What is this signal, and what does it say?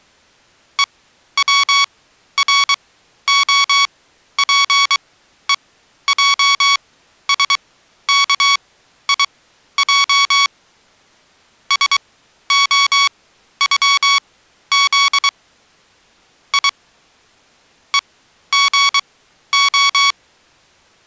Morse code (Russian alphabet), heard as electronic beeps, machine-sent, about 23 wpm, spaced as for 12 wpm, 1120 Hz. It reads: ЕВРОПЕЙСКИЙ СОЮЗ И ЕГО